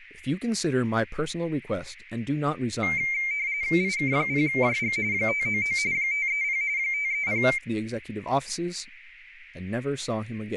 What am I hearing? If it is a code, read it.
RTTY (45.45 baud, 170 Hz shift), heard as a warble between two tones, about 2200 Hz centre, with radio static, a narrow filter and speech in English. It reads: IK0JG 599 530 530